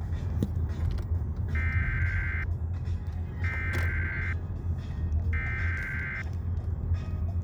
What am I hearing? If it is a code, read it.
Emergency Alert System (SAME) tones (header bursts), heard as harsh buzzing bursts, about 520.83 baud, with the noise inside a car.